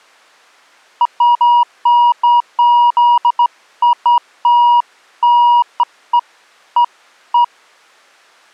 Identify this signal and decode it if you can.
Beeps of irregular length. There is no code.